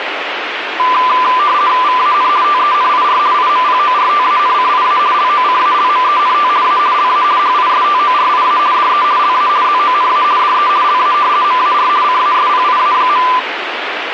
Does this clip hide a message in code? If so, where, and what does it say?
Yes: RTTY (50 baud, 170 Hz shift) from 0.8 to 13.4 s, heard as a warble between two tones, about 1100 Hz centre, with radio static. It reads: VAN TENIR IMPORTANCIA LOCALMENT A LA HISTORIA DE LA ZONA DE LA MAR CASPIA.